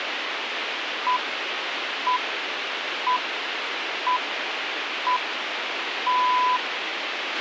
Radio time signal (six pips, as the Greenwich Time Signal), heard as pips, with radio hiss and a squelch burst at the end.